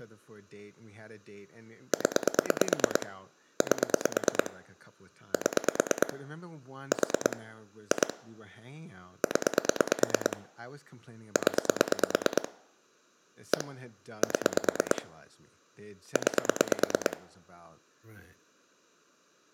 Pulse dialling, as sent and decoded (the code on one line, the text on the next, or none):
10 / 8 / 7 / 4 / 2 / 10 / 10 / 1 / 7 / 9
0 8 7 4 2 0 0 1 7 9